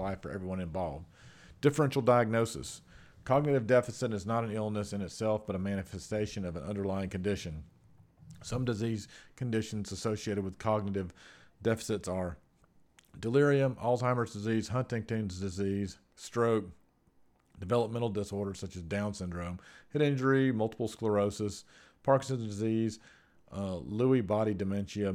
Speech in English. There is no code.